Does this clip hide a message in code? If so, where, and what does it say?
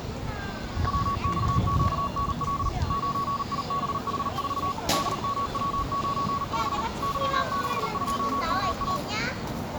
Yes: Morse code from 0.8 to 9.0 s, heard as a keyed tone, machine-sent, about 39 wpm, 1120 Hz, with the noise of a residential street. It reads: WXQNL 9IBH4 DMW95 Y62MA